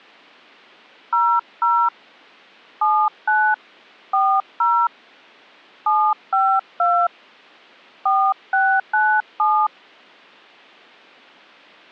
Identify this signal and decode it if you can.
DTMF, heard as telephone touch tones, dialled by hand, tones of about 270 ms. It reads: 00 79 40 752 4697